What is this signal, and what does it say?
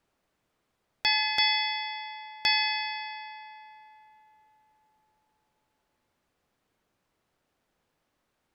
Ship's bell, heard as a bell. 3. Three half-hours of the watch have passed.